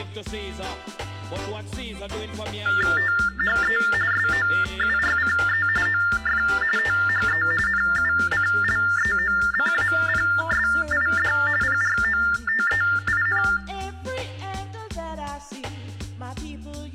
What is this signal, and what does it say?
TTY/TDD text telephone tones (45.45 baud Baudot), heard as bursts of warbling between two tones, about 400 Hz shift, 1600 Hz centre. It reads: THE SOURCE OF THE NUCLEOCAPSID PROTEIN